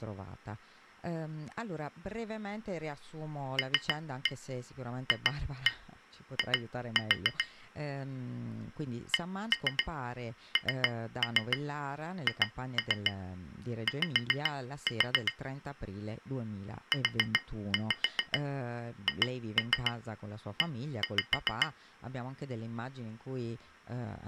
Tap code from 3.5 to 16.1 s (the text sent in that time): LFI CNHY